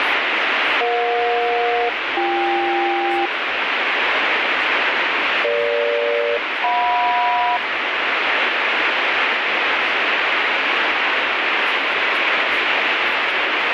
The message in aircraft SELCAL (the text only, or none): EJ-BK EG-JM